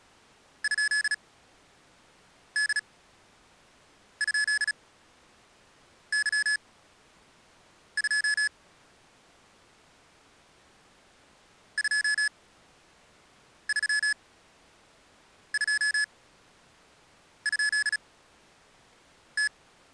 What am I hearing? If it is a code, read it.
Morse code, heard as electronic beeps, machine-sent, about 36 wpm, spaced as for 6 wpm, 1700 Hz. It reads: ?D?Y2 232?T